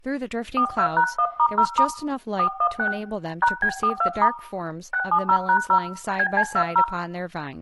DTMF, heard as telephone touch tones, dialled by hand, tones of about 70 ms, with room echo and speech in English. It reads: 42#1*0* 416 #B42* 670#0 BC20